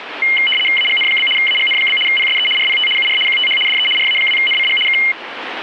RTTY (75 baud, 850 Hz shift), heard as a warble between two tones, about 2550 Hz centre, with radio static. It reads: AGN? AGN? PSE RPT UR QTH DE RA2NCG K